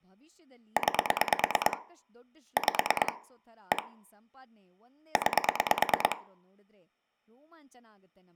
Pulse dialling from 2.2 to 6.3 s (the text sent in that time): 5 1 9